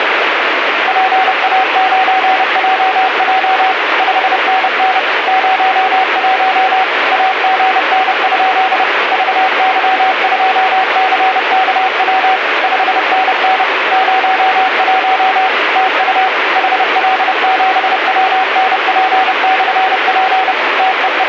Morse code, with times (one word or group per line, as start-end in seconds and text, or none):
0.9-3.7 PA9JJ
4.0-5.0 5NN
5.3-6.8 01
7.1-8.8 AGN?
9.1-12.4 VY2CKW
12.6-13.6 5NN
13.9-15.5 01
15.8-16.3 TU
16.6-20.5 HL7WNP/P
20.8-21.3 …